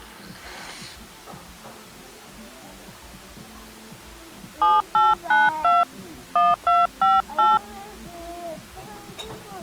DTMF, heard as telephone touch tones, dialled by hand, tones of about 190 ms, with the noise of a restaurant. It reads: 7892 1258